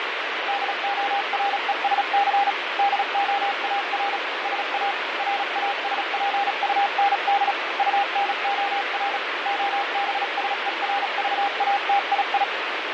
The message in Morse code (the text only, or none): DORESC DOAR SA RASPUND UNOR OBSERVATII